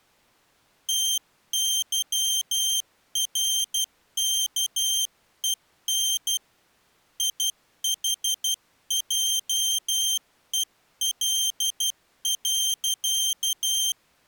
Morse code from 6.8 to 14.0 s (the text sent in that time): IHJEL.